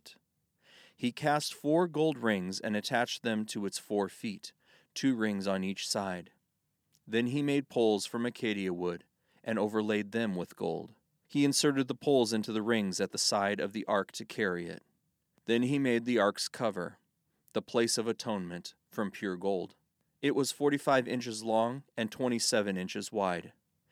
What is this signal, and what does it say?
Speech in English. There is no code.